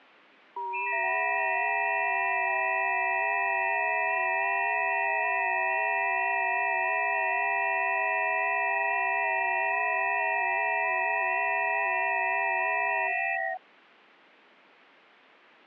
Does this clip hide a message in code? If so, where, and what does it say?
Yes: FT8 (several signals at once) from 0.6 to 13.6 s, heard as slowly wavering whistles, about 6.25 baud.